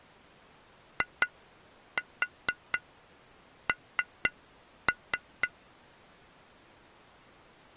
Tap code, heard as taps on glass, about 4 knocks a second. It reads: IN